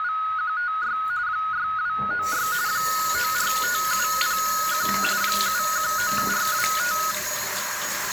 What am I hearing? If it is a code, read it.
RTTY (45.45 baud, 170 Hz shift), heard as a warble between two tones, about 1360 Hz centre, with radio static and the noise of a restroom. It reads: … 6296 945701 719425